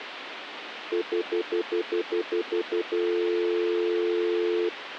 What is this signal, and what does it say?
Telephone call progress tone (North American plan), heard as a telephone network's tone, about 350, 440 Hz, 0.1 s on and 0.1 s off, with phone line noise. Stutter dial tone.